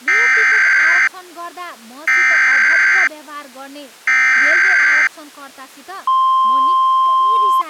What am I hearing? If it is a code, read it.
Emergency Alert System (SAME) tones (header bursts, then the 1050 Hz attention tone), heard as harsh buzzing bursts, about 520.83 baud, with speech in Nepali.